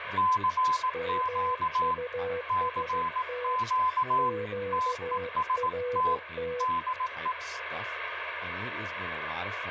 Morse code, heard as two keyed tones, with radio static and speech in English. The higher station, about 18 wpm, 1020 Hz: CQ CQ TEST DE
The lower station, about 15 wpm, 490 Hz: MUST QRT